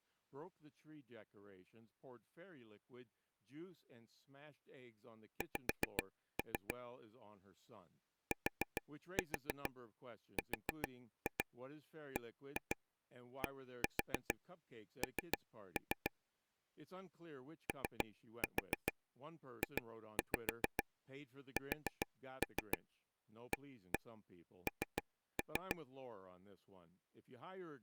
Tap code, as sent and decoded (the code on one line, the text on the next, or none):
5-3 / 4-4 4-2 1-2 1-4 3-3 / 3-4 2-5 4-3 1-1 3-3
X TRBDN OJSAN